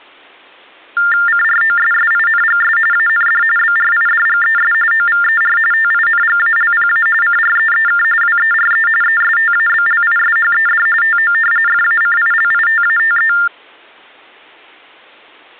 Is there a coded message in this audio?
Yes: TTY/TDD text telephone tones (45.45 baud Baudot) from 1.0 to 13.5 s, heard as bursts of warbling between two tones, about 400 Hz shift, 1600 Hz centre. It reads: CROSSINGS AND BRIDGES OVER TINGALPA CREEK WERE ESTABLISHED TO FACILITATE